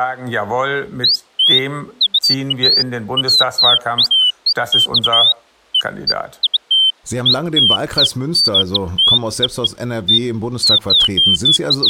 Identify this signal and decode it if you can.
Bird-like chirps, with speech in German. There is no code.